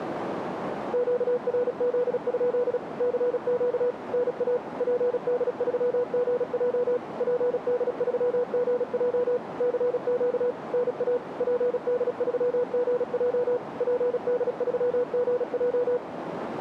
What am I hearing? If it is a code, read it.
Morse code, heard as a keyed tone, machine-sent, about 36 wpm, 490 Hz, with radio static and a narrow filter. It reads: QRZ? CQ NA PD3GJ PD3GJ CQ NA PD3GJ PD3GJ